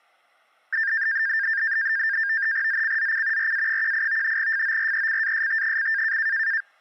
NAVTEX (SITOR-B), 100 baud, 170 Hz shift, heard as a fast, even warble, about 1700 Hz centre. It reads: ZCZC RA18 FORECAST: